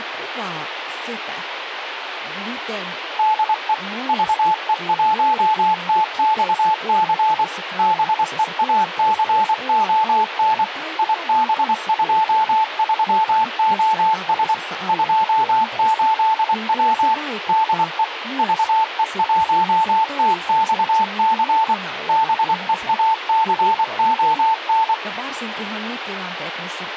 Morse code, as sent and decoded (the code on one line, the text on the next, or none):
-.. . / ...- . .---- - -..- -.-. / -... . .- -.-. --- -. / .. -... ..--- ...-- --- ... / ..--- ---.. .-- / -.. . / ...- . .---- - -..- -.-. / -... . .- -.-. --- -.
DE VE1TXC BEACON IB23OS 28W DE VE1TXC BEACON